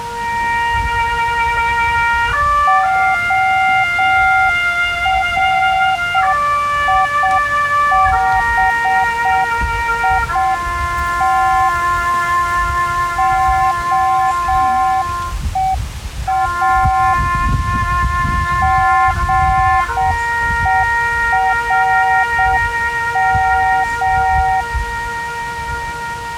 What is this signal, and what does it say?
Morse code (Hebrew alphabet), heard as a keyed tone, hand-sent with a straight key, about 7 wpm, 760 Hz. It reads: הריבית הוא גורם